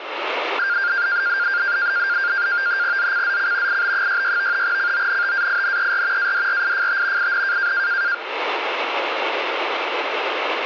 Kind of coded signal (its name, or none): NAVTEX (SITOR-B)